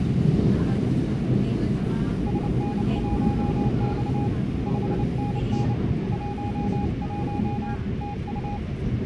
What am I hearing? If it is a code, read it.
Morse code, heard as a keyed tone, hand-sent with a paddle, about 29 wpm, 820 Hz, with the noise inside a subway train. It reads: SN1X 5NN 11 TU